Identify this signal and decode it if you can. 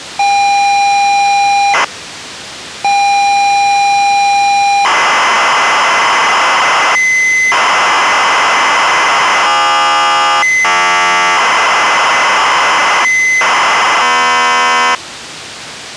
ZX Spectrum tape loading, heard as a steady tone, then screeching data.